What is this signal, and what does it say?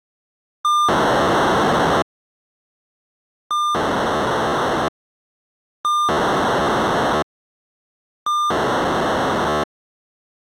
POCSAG pager data (2400 baud), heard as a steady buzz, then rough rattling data.